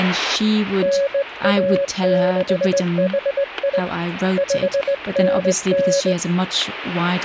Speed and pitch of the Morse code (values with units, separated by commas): 19 wpm, 560 Hz